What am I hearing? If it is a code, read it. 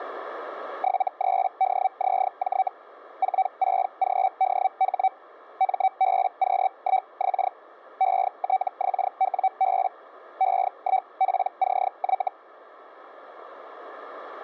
Hellschreiber (Feld-Hell, 122.5 baud), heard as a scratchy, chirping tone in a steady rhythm, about 760 Hz. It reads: 73DZJ 46GDH MBQ1X ETXWB E1PCY